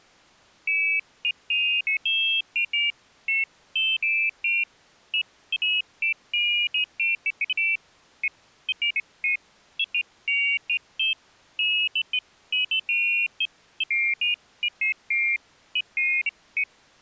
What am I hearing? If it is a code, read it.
Pairs of high tones at irregular times. There is no code.